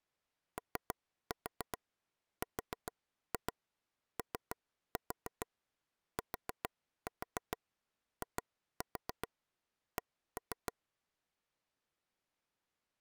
Tap code, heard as taps on a table, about 7 knocks a second. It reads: OROTIC